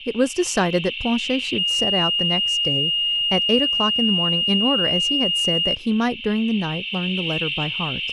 A steady tone, with radio static and speech in English. There is no code.